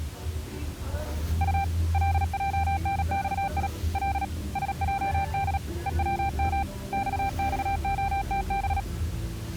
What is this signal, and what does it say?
Morse code, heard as a keyed tone, hand-sent with a paddle, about 37 wpm, 790 Hz, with the noise inside a car. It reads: U LJNXI L SJD EWM XXOTB